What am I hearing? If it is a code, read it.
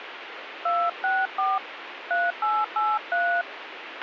DTMF, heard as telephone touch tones, dialled by hand, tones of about 250 ms, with radio hiss and a squelch burst at the end. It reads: 264 3883